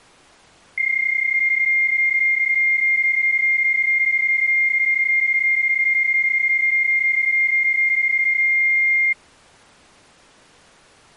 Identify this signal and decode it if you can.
PSK31 (31.25 baud), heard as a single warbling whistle, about 2100 Hz.